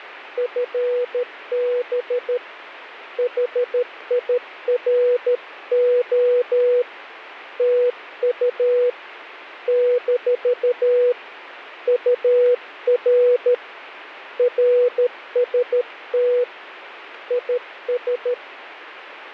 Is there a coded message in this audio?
Yes: Morse code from 0.3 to 18.4 s, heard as a keyed tone, hand-sent with a paddle, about 13 wpm, 490 Hz, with radio static. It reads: FB HIRO TU - UR RST IS